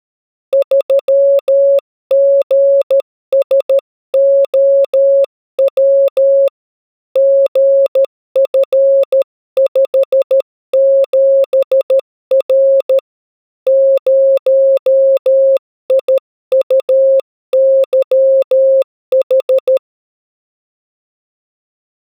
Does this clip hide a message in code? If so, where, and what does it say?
Yes: Morse code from 0.5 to 19.8 s, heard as a keyed tone, hand-sent with a paddle, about 13 wpm, 550 Hz. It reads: 3GSOW GF57R 0IUYH